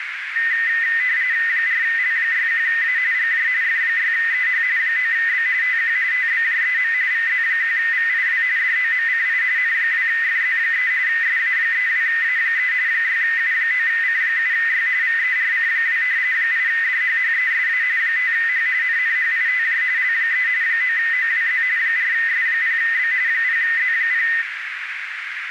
RTTY (45.45 baud, 170 Hz shift), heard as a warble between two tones, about 1900 Hz centre, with radio static and a narrow filter. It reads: 4L61A GJ F6EH 9B TQ TBJEM VZ1VIW DOMCI N2FZ3 SA32A3 6U9C7Y VERC2 8DHHESA 5H NNHITJ L3 9OWZ 4S0B 0Z0